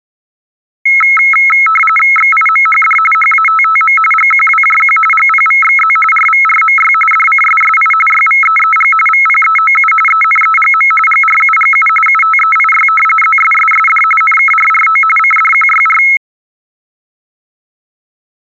RTTY (45.45 baud, 850 Hz shift), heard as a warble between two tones, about 1750 Hz centre. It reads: XIMHD HATTM GQWJQ GPVXZ RVRMY DCSSI YVEEG VPEOU ENEGM GRUGU UTEIY ZSSSD NKRRO CDQYR